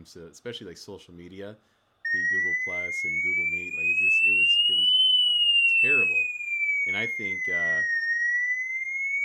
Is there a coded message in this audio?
No, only a tone that sweeps in pitch again and again, with room echo and speech in English.